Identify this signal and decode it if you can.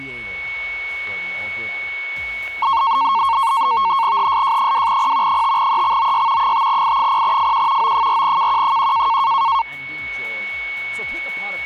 NAVTEX (SITOR-B), 100 baud, 170 Hz shift, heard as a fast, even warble, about 1000 Hz centre, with a steady whistle near 2220 Hz. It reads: HSJ2P 5EXOY 5I0FQ O4KQ1